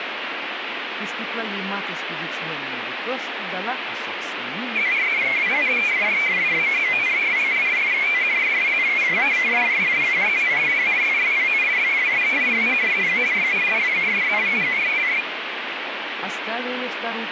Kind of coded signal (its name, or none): multi-tone FSK (Olivia or MFSK type)